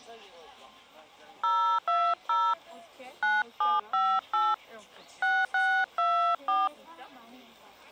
DTMF, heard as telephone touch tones, dialled by hand, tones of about 300 ms, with the noise of a park. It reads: 020 9758 6624